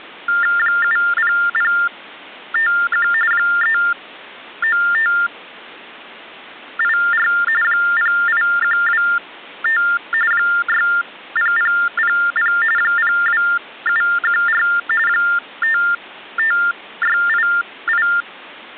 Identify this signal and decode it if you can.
TTY/TDD text telephone tones (45.45 baud Baudot), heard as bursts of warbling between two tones, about 400 Hz shift, 1600 Hz centre. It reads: 70051 39584 08125 60000 02714 55688